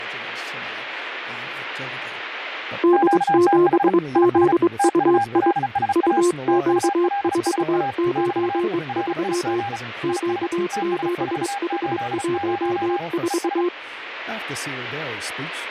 Morse code, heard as two keyed tones, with radio static and speech in English. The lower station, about 23 wpm, 360 Hz: D7ZUI UQ493 Q7H14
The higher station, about 35 wpm, 800 Hz: QTH IS TULSA TULSA <BT> RIG IS TS480 ES